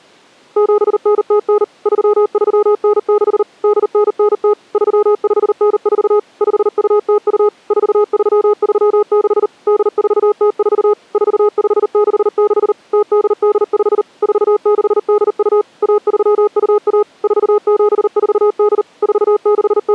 Morse code (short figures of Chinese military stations), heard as a keyed tone, machine-sent, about 39 wpm, 420 Hz. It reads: 7909 3396 8990 3594 5202 4336 8404 4566 0885 4682 1321 4748 …